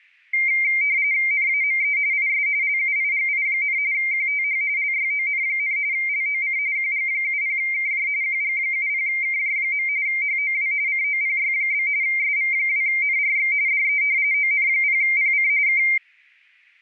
RTTY (45.45 baud, 170 Hz shift), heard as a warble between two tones, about 2200 Hz centre. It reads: NAME IS LUIGI, QTH LYON, LOC QG70KJ QG70KJ. HOW COPY? SV2NRX DE ON0PC K